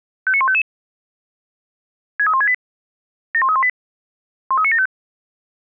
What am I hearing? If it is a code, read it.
Five-tone selective call (ZVEI), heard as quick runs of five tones, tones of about 70 ms. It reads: 59155 63168 71318 13975